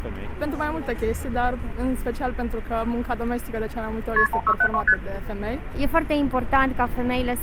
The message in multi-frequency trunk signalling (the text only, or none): KP 1672 ST